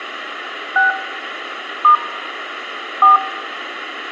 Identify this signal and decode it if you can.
DTMF, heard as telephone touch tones, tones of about 140 ms, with radio hiss. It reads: 6 * 4